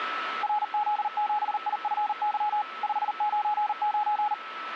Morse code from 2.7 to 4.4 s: 599

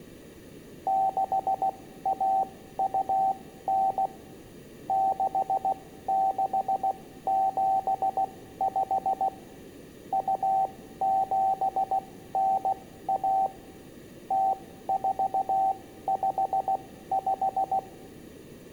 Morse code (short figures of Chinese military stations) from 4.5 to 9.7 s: 6675

